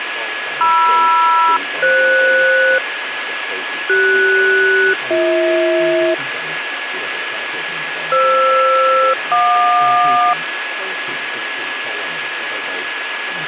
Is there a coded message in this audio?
Yes: aircraft SELCAL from 0.6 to 10.3 s, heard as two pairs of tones, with radio static and a steady whistle near 1690 Hz. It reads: MR-FS CS-BH FR-JQ